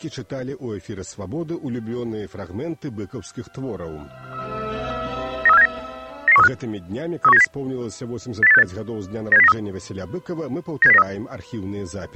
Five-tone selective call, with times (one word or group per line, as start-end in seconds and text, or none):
5.5-5.7 93479
6.3-6.5 99135
7.2-7.4 31970
8.4-8.6 80868
9.3-9.5 97093
10.8-11.0 97093